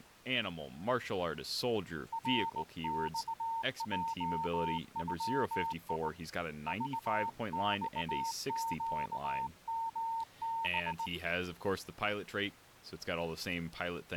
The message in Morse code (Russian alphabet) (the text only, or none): РЬЙЮИ ЖЬЩМБ